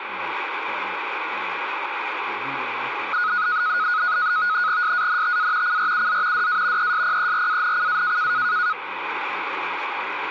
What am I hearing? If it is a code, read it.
NAVTEX (SITOR-B), 100 baud, 170 Hz shift, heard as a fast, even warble, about 1360 Hz centre, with radio static and speech in English. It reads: SANTA CRUZ DA ESPERANCA